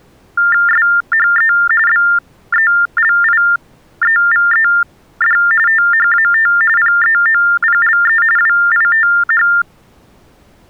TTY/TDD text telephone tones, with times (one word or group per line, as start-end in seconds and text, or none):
0.7-1.5 SHE
1.9-5.4 BELIEVED
5.7-6.5 THAT
6.8-8.2 PEOPLE
8.4-9.5 WITH